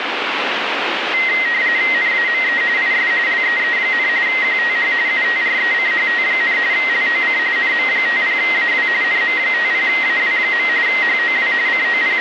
RTTY (45.45 baud, 170 Hz shift), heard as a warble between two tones, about 2000 Hz centre, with radio static. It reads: NAME IS LEE, QTH UTRECHT, LOC NM50AW NM50AW. HOW …